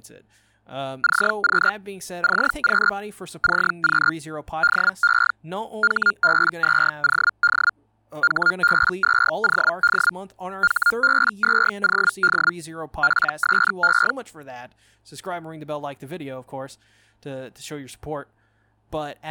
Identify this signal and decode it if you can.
Hellschreiber (Feld-Hell, 122.5 baud), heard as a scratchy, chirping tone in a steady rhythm, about 1410 Hz, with speech in English. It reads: CQ CQ CQ DE HB2OD HB2OD HB2OD PSE